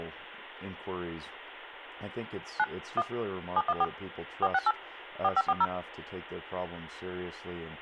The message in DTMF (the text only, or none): 9 1 714 468 4540